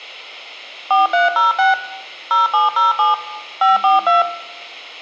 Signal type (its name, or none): DTMF